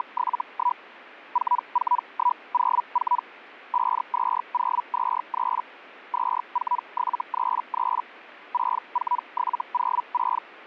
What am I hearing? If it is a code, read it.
Hellschreiber (Feld-Hell, 122.5 baud), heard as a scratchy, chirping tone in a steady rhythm, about 980 Hz. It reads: … 44104 52023 24733 64706